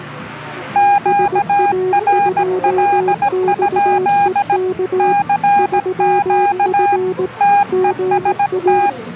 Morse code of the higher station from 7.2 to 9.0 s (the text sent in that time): TEST